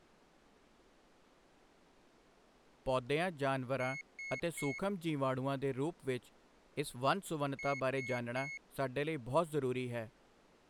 Beep code, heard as a piezo beeper, played twice, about 2200 Hz, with speech in Punjabi. 3 short. In AMI BIOS tables: failure in the first 64 KB of memory; in Dell tables: chipset error.